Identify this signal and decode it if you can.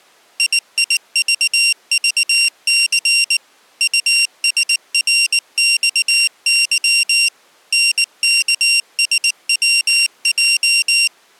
Morse code, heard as a high beeper, machine-sent, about 19 wpm, 2750 Hz. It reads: IIVVC USRXY NKSWJ